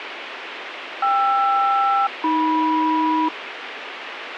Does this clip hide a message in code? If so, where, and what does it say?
Yes: aircraft SELCAL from 1.0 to 3.3 s, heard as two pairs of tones, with radio hiss. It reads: KR-AM